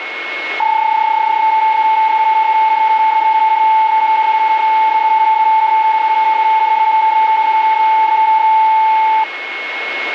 PSK31 (31.25 baud), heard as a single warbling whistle, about 880 Hz, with radio static and a steady whistle near 2180 Hz.